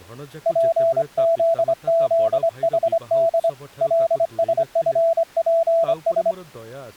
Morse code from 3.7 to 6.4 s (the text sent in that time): LSFPS